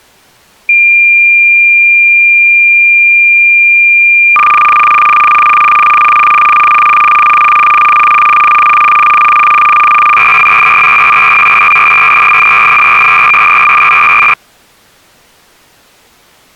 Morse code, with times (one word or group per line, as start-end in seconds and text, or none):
none